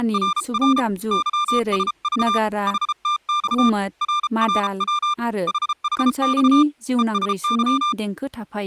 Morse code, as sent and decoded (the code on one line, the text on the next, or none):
… / -.-- ... ...- / .... - -..- / .-. .-. .-- / .... .... -..- / . ... -.--
… YSV HTX RRW HHX ESY